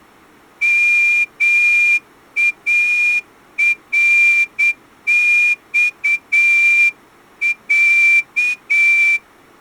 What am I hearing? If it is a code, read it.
Morse code (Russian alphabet), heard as a whistle, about 8 wpm. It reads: МАРЬЯ